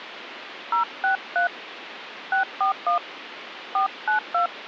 DTMF, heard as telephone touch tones, dialled by hand, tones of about 120 ms, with phone line noise. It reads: 063 641 492